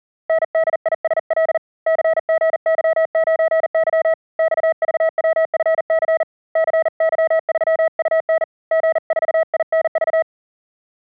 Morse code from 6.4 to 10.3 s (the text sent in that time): CY3UN G4INV